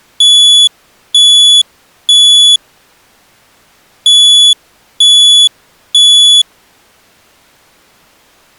Alarm pattern, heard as an alarm's beeps, played twice, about 3400 Hz. Temporal three. Smoke or fire, evacuate.